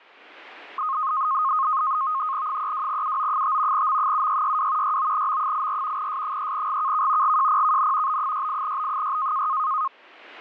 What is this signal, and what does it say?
NAVTEX (SITOR-B), 100 baud, 170 Hz shift, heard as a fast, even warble, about 1160 Hz centre. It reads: 32UO5 M7662 69M84 S3GKK GJPKN B68B6